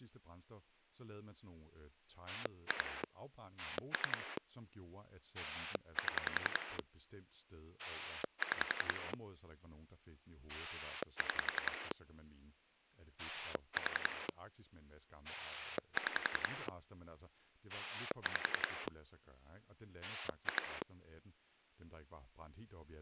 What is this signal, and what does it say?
Pulse dialling, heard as a rotary dial, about 11 pulses a second, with speech in Danish. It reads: 2 3 7 6 6 4 6 5 2